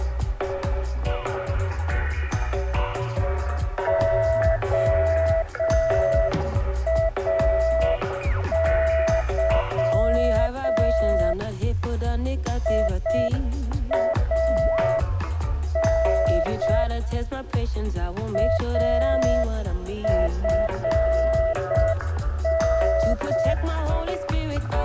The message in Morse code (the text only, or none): OAY IAN AFN